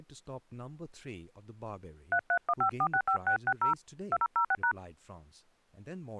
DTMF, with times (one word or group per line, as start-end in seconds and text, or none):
2.1-3.7 3315465660
4.1-4.7 2006#